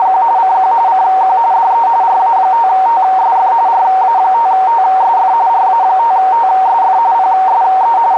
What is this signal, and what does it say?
RTTY (45.45 baud, 170 Hz shift), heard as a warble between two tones, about 840 Hz centre, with radio static and a narrow filter. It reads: … CQ CQ DE RA5TSF RA5TSF RA5TSF PSE …